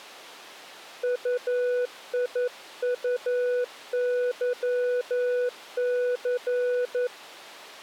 Morse code, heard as a keyed tone, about 11 wpm, 490 Hz. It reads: UIUYC